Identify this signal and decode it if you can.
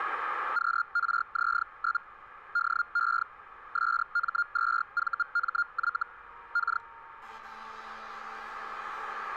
Hellschreiber (Feld-Hell, 122.5 baud), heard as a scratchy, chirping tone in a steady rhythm, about 1410 Hz, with street noise. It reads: QRZ? DE SM2VMY K